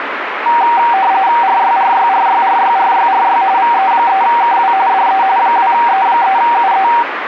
RTTY (45.45 baud, 170 Hz shift), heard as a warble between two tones, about 860 Hz centre, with radio static. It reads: RYRYRYRYRYRY VE3KW DE 2E3UE